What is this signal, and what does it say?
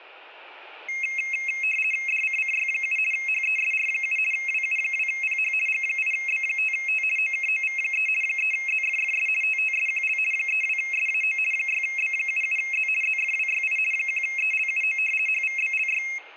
RTTY (50 baud, 450 Hz shift), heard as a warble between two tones, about 2350 Hz centre, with room echo. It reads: DCCY7 HESR7 WU2PH G8B5T OKOV3 3ZFFS TTSQL 32SAO 6B77Z ZFWYI 1ELUO HVBLY